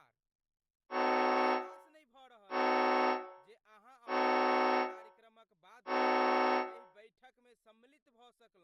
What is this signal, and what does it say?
Train horn signal, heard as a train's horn, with room echo and speech in Maithili. 4 short. On North American railways: a request for a signal to be given or repeated.